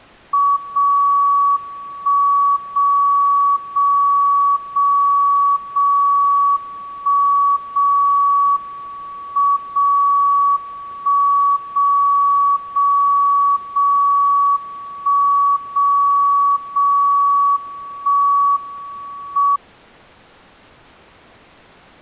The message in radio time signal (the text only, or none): 0 1 0 0 0 0 1 0 M 0 1 0 0 0 1 0 0 1 M